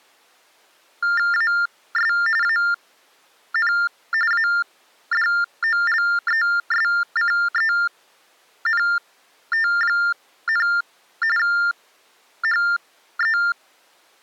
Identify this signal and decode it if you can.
TTY/TDD text telephone tones (45.45 baud Baudot), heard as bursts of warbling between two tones, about 400 Hz shift, 1600 Hz centre. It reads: AS AN ADOLESCENT, HE